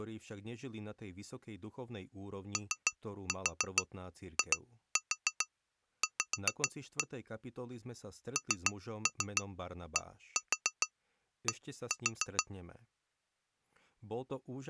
Tap code, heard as taps on glass, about 6 knocks a second, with speech in Slovak. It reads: OIV NDD